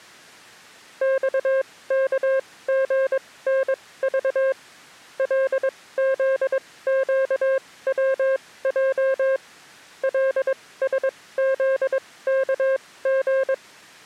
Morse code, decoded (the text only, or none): XKGNV LZQWJ LSZKG